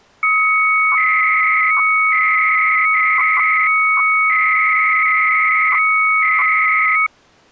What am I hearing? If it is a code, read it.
300-baud modem data (Bell 103 tones), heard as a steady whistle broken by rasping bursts, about 300 baud, 200 Hz shift.